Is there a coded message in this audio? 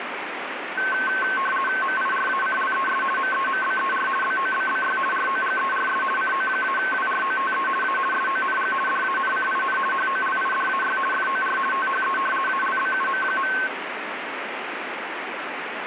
Yes: RTTY (50 baud, 450 Hz shift) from 0.8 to 13.7 s, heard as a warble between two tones, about 1310 Hz centre, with radio static. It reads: MIRACLES MEMBER BOBBY ROGERS CO-WROTE A SONG DANCIN HOLIDAY FOR THE ALBUM.